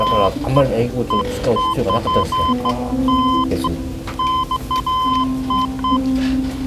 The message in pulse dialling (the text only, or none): none